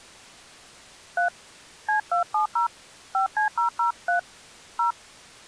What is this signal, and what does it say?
DTMF, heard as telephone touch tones, dialled by hand, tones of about 120 ms. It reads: 3 C270 5C003 0